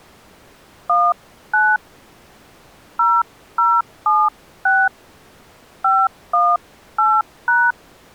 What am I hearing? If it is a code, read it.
DTMF, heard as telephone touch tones, dialled by hand, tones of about 230 ms. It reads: 19 0076 518#